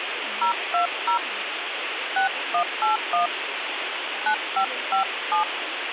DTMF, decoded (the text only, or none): 020 6181 9557